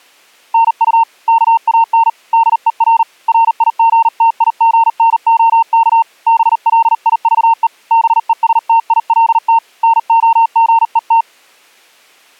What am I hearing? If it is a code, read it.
Morse code, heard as a keyed tone, hand-sent with a paddle, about 39 wpm, 910 Hz. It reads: NU KAN DER RIGTIGNOK BLIVE BESTILT NOGET